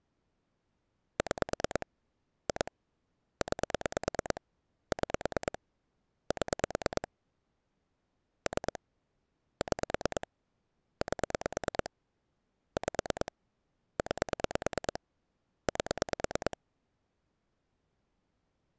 Pulse dialling, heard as clicks on a phone line, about 9 pulses a second. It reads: 6 2 9 6 7 3 6 8 5 9 8